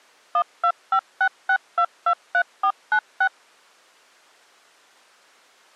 DTMF, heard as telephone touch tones, dialled by machine, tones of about 70 ms. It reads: 12566223496